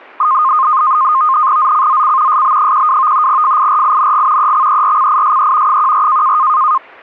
NAVTEX (SITOR-B), 100 baud, 170 Hz shift, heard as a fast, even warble, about 1150 Hz centre. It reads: ZCZC SB12 FIRING EXERCISE 14